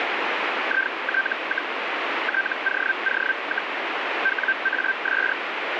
Hellschreiber (Feld-Hell, 122.5 baud), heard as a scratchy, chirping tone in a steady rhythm, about 1550 Hz, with radio static. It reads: IT, TOO, WAS